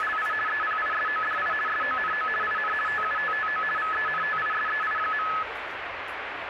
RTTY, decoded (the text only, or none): … EPISODI SONO IN TUTTO VENTISEI.